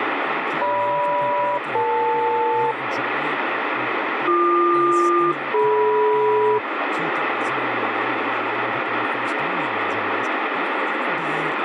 Aircraft SELCAL, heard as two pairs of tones, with radio static and speech in English. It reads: GM-EL BQ-DM